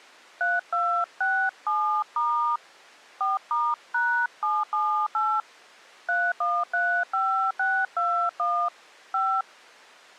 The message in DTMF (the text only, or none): 3267* 4*#778 3135621 5